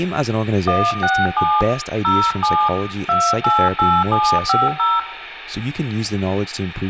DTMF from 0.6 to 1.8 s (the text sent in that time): 167